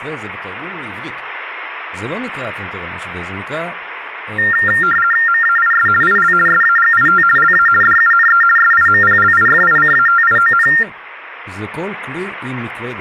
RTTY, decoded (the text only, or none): MAIS IL SAGIT LA DUNE SIMPLIFICATION